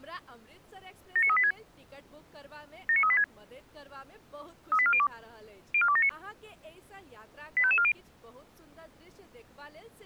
Five-tone selective call (ZVEI), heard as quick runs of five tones, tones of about 70 ms, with speech in Maithili. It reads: 79386 79386 38402 04279 85540